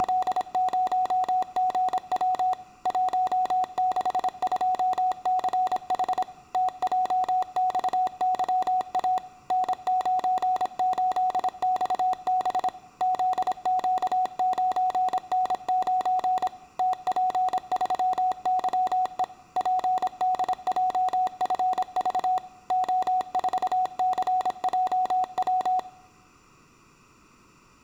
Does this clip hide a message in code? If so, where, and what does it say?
Yes: Morse code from 0.0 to 25.9 s, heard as a keyed tone, machine-sent, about 26 wpm, 740 Hz, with room echo. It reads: … 162CH TJXYA N98XB ZQ9N9 TP3YE PDJFV O4CJW